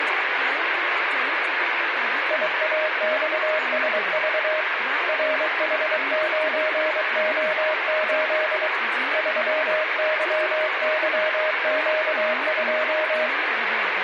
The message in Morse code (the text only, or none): IAXSV RH9O8 3YYQ2